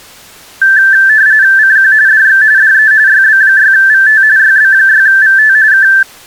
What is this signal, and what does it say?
RTTY (45.45 baud, 170 Hz shift), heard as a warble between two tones, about 1650 Hz centre. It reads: CQ DX DE YB6VT YB6VT K